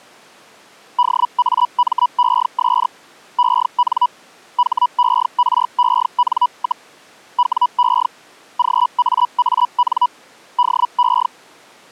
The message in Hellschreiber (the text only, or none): DAMES EN HEREN, WE GAAN DE